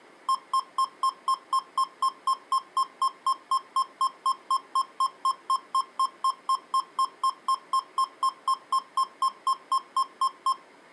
Evenly repeated beeps. There is no code.